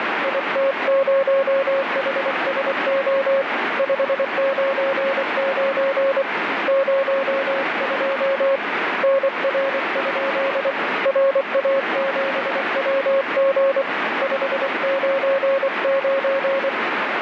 Morse code, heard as a keyed tone, hand-sent with a paddle, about 24 wpm, 540 Hz, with heavy radio static. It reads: IT0HSO 599 02 NR? RA7WG 599